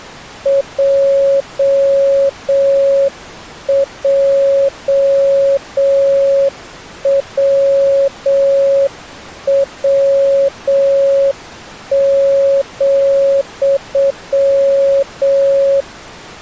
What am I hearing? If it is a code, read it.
Morse code, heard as a keyed tone, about 7 wpm, 550 Hz. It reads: JJWW,